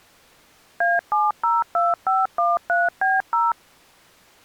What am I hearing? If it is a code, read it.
DTMF, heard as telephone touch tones, dialled by machine, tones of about 190 ms. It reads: A702513B0